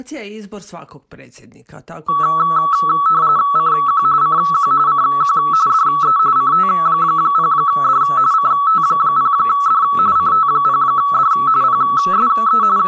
RTTY (45.45 baud, 170 Hz shift), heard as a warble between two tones, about 1220 Hz centre. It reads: CQ CQ CQ DE CT0D CT0D CT0D PSE …